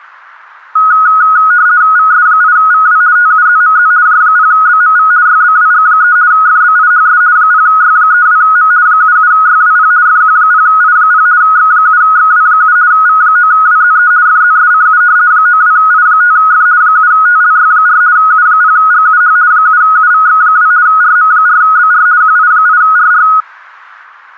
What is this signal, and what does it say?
RTTY (50 baud, 170 Hz shift), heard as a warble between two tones, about 1360 Hz centre. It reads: VS8VW TUZMZ J0BMV YBWG3 FBIHS 0Y32M 77YWP FQ0I0 X7XW7 V9WZE FZSCU 92I5F 7TLY4 U0GUH 7UVX2 RM4BR QI8RR